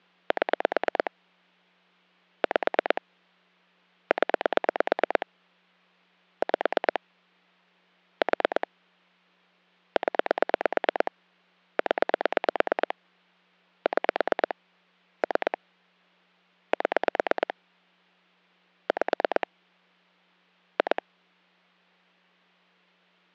Pulse dialling, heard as clicks on a phone line, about 9 pulses a second. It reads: 7 5 0 5 4 0 0 6 3 7 5 2